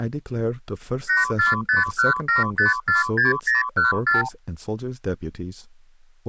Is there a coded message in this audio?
Yes: multi-frequency trunk signalling (R2, with the far end's replies) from 1.1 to 4.3 s, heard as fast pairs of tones, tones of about 150 ms, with speech in English. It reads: 84517546014